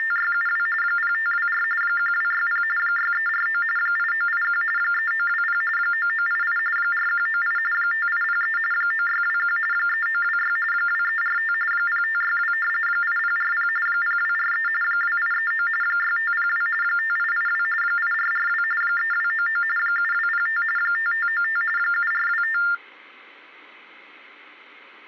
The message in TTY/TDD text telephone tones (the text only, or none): … 0524 1260 6349 8981 3920 9988 4198 5803 9621 3926 2345 0562 8040 0243 2839 6502 5882 8442 3299 7205 5595 7425